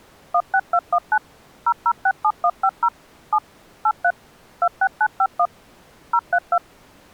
DTMF, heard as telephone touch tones, dialled by machine, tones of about 60 ms. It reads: 16219 0067150 7 83 26951 032